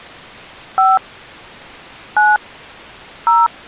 DTMF, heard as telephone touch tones, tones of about 200 ms. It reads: 5 9 0